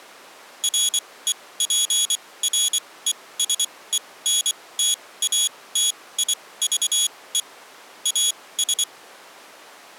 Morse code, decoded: REPRESENTATIVE AS

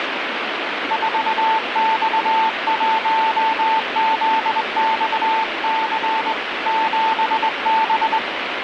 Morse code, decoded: 4X1ZXC 7B

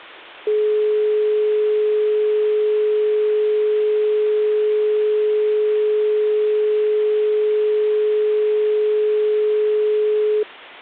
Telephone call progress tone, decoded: dial tone

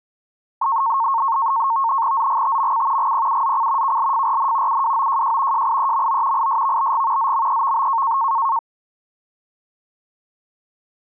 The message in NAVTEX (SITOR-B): ZGTMC GPUZC KLFRN UWOJJ JIEMO ISVBG ZMEVB

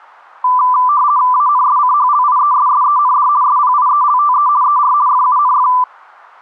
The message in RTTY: ANSCHLIESSEND SPIELTE ER FUNF

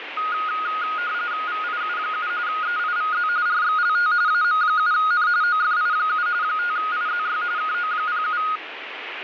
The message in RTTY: VIU7 EIVZ RXLT AM7N OFI7 5IZY KO07

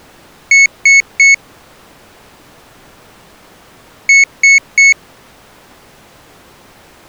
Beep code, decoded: 3 short

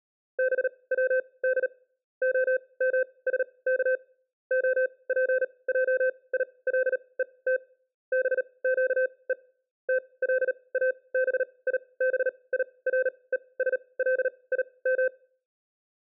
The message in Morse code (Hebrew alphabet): בצד המשך הפעילות בקו תלאביבירושלים

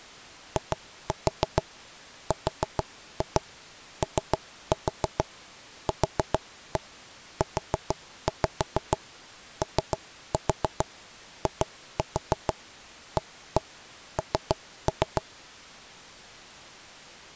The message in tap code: IROQUOIAN

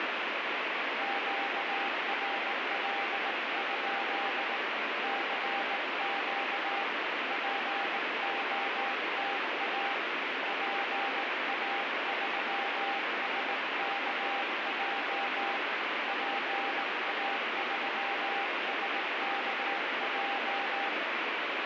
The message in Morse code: QRL? CQ POTA PA3SKJ PA3SKJ

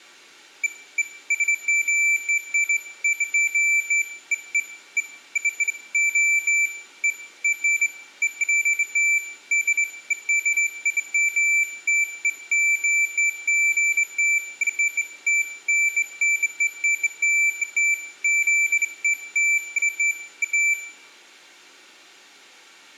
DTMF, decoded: none

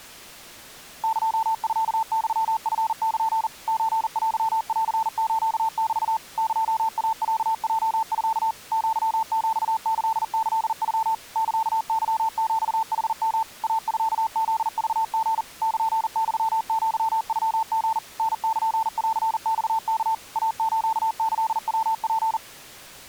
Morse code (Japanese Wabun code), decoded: エミユチル ソテンスメ エイロヲミ アヒキキノ サケヒヌヨ イミフクリ ルユアノリ タルンマワ イスキヤツ

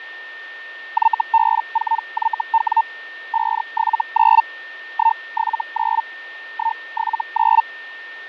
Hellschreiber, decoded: YB4YW 579 179 179

